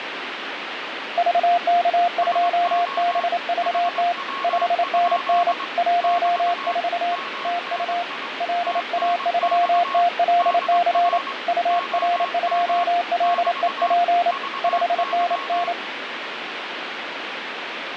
Morse code, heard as two keyed tones, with radio static. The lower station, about 28 wpm, 700 Hz: VK2BVT 5NN 14 TU LA3TLC UR2LEP 5NN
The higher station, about 22 wpm, 1100 Hz: SO HW? <BT> MNI TNX DR OM <BT> VY